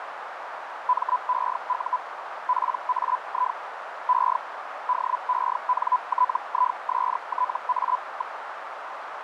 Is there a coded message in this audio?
Yes: Hellschreiber (Feld-Hell, 122.5 baud) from 0.9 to 8.4 s, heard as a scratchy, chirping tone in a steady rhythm, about 1000 Hz, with radio static and a narrow filter. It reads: MEU PAI E DENTISTA.